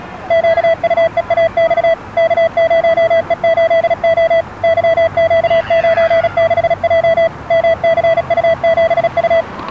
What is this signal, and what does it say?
Morse code, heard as a keyed tone, machine-sent, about 36 wpm, 660 Hz, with the noise of a residential street. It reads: QUEAX K0E8O YQ96J MCU7U